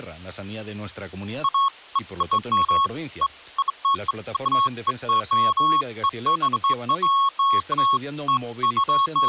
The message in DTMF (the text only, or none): none